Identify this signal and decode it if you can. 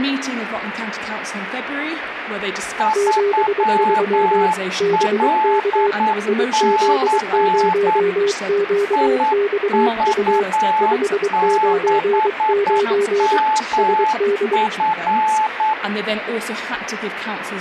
Morse code, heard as two keyed tones, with radio static. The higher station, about 9 wpm, 870 Hz: 3LC IV6MF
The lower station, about 23 wpm, 400 Hz: 73 BK IZ0QXU 599 SD